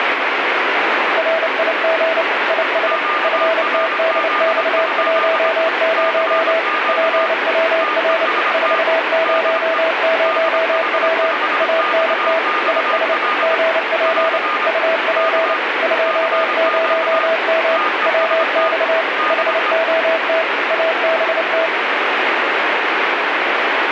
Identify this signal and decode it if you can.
Morse code, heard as two keyed tones, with heavy radio static. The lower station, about 29 wpm, 650 Hz: RIG IS FTDX10 PWR 400W ANT IS GP UP 20M WX HOT ABT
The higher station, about 24 wpm, 1220 Hz: QRZ? CQ TEST DE DH5XXL <AR> K CQ TEST DE